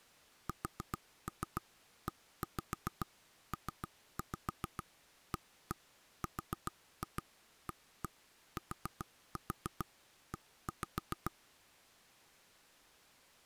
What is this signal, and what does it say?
Tap code, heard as knocks on wood, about 7 knocks a second. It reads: SEPARATE